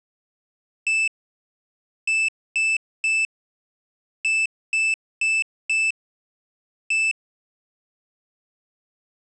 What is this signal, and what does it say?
Beep code, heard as a piezo beeper, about 2650 Hz. 1-3-4-1. In Phoenix BIOS tables: memory failure on an address line.